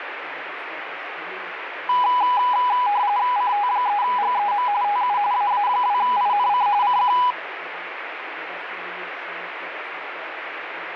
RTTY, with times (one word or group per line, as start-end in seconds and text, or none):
3.4-4.7 CT3GEM
4.8-5.2 TU
5.3-6.7 AA2INC
6.8-7.2 CQ